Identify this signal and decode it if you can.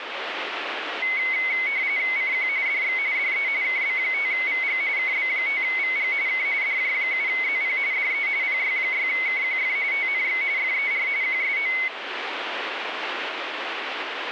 RTTY (45.45 baud, 170 Hz shift), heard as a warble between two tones, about 2150 Hz centre, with radio static. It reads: CQ DX DE KB5VG KB5VG K DJ7ZP DE PY6KQF TNX FER QSO